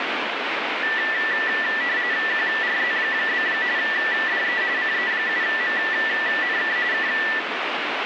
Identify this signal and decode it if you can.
RTTY (45.45 baud, 170 Hz shift), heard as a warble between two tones, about 1850 Hz centre, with radio static. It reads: QRZ? DE CE7MNK K